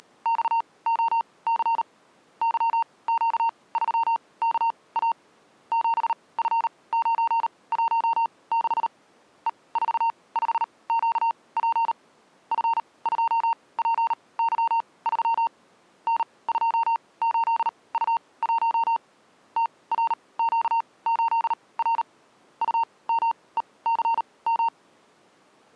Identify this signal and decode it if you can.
Morse code, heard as a keyed tone, machine-sent, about 38 wpm, spaced as for 23 wpm, 920 Hz. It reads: … YQ3KA 7F916 E45QP F2PY3 N28U1 TRQ8R UMECM